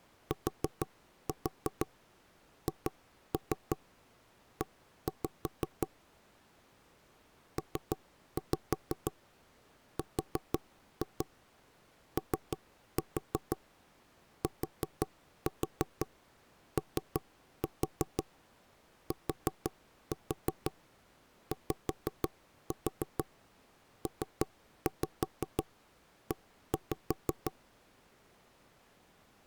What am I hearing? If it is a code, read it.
Tap code, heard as knocks on wood, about 6 knocks a second. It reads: THE PROTOTYPE